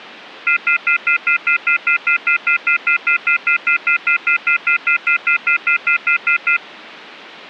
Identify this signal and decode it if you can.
Telephone call progress tone (North American plan), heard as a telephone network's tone, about 1400, 2050, 2450, 2600 Hz, 0.1 s on and 0.1 s off. Off-hook warning tone.